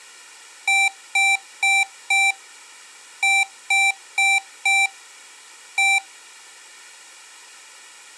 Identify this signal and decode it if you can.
Beep code, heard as beeps from a small speaker, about 780 Hz. 4-4-1. In Phoenix BIOS tables: serial port failure.